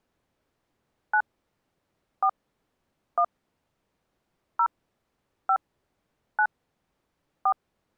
DTMF, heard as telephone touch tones, dialled by hand, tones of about 70 ms. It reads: 9 4 1 0 5 9 4